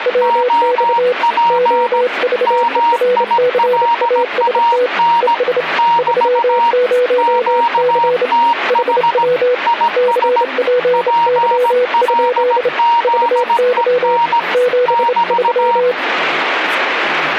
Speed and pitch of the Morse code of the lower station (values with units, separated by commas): 28 wpm, 500 Hz